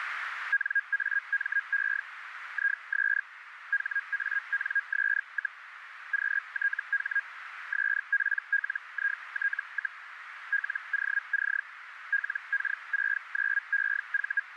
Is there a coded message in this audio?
Yes: Hellschreiber (Feld-Hell, 122.5 baud) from 0.5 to 14.4 s, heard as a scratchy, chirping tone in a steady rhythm, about 1650 Hz, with radio static and a narrow filter. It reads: NAME IS HANS, QTH SPLIT, LOC LK69EV